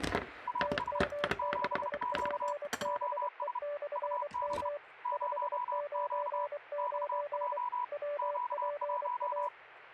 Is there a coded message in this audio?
Yes: Morse code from 0.4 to 9.5 s, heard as two keyed tones, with kitchen noise. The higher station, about 32 wpm, 980 Hz: AS 7Q OS UB 0Q XJ Q1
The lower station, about 24 wpm, 580 Hz: TM6PBE/M 599 WPA